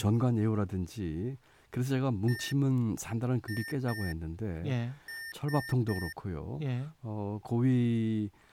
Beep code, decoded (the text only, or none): 1-2-3